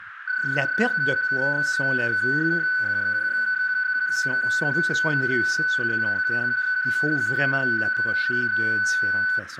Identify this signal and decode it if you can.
PSK31 (31.25 baud), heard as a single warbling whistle, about 1500 Hz, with radio static, a narrow filter and speech in French.